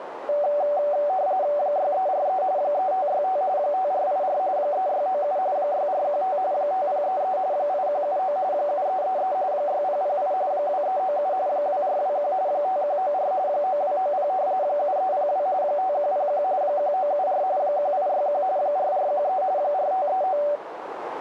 RTTY (45.45 baud, 170 Hz shift), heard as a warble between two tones, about 670 Hz centre, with radio static and a narrow filter. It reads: 6343 3565 5484 3697 6415 5033 8179 7333 6008 2397 2421 5194 9290 7302 5101 1974 1861 4413 4539